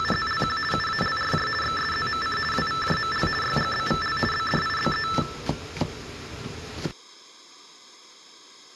RTTY (50 baud, 450 Hz shift), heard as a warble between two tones, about 1550 Hz centre, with kitchen noise. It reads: … UALRJ XSZMC WVJML YGBVL BDIBE